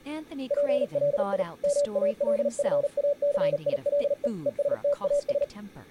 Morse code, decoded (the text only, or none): PLI MALFACILE ESTAS